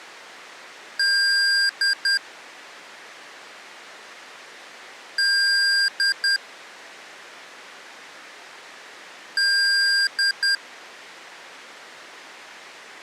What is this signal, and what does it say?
Beep code, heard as beeps from a small speaker, played three times, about 1600 Hz. 1 long, 2 short. In Award, IBM and AMI BIOS tables: video adapter failure.